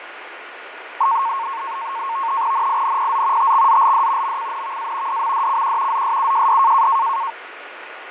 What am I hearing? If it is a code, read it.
NAVTEX (SITOR-B), 100 baud, 170 Hz shift, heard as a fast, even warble, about 1000 Hz centre, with radio static and fading. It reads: NINPZ TXZLD MCNVA DMDCQ ZSUJD